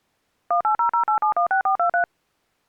DTMF, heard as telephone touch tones, dialled by machine, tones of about 100 ms. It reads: 18008716423